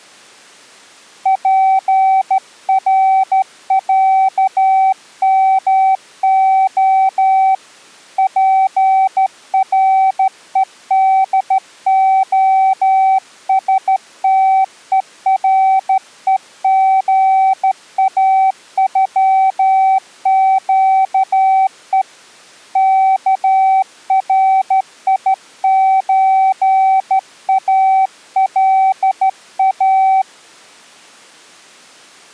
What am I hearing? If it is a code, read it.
Morse code (Russian alphabet), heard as a keyed tone, hand-sent with a straight key, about 13 wpm, 770 Hz. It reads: ПРЯМО ПРЕДОСТЕРЕГАЮЩЕ КРИЧАЛА